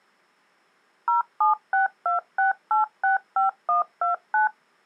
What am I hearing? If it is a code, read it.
DTMF, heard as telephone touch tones, dialled by machine, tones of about 130 ms. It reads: 07626865129